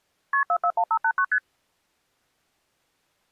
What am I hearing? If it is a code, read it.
Multi-frequency trunk signalling (R1, as on North American trunks), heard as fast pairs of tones, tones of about 70 ms. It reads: KP 441589 ST